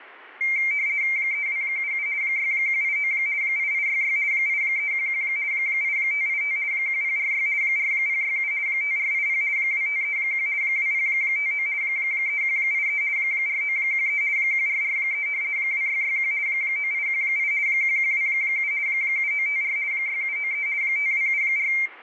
RTTY (50 baud, 170 Hz shift), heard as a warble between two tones, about 2200 Hz centre, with room echo. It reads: 3277 6189 8866 8311 8585 1046 4067 5480 2531 2059 3183 4913 1443 2661 9818 1127 7954 6793 5274